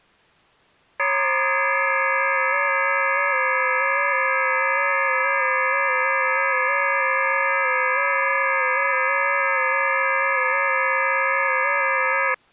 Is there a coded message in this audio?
Yes: FT8 (several signals at once) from 1.0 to 12.3 s, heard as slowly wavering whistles, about 6.25 baud.